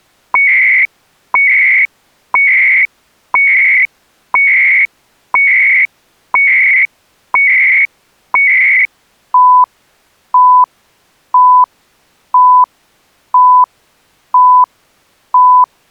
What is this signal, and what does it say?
Radio time signal (CHU, Canada), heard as beeps and data bursts, one a second.